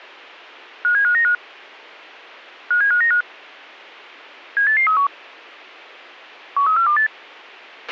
Five-tone selective call (CCIR), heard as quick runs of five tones, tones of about 100 ms, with a squelch burst at the end. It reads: 57595 57595 78831 13428